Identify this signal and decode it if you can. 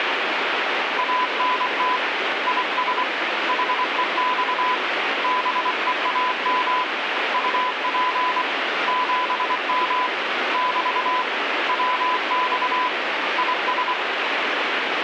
Morse code, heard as a keyed tone, hand-sent with a paddle, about 24 wpm, 1000 Hz, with radio static. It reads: ANT IS HEX BEAM UP 7M <BT> WX IS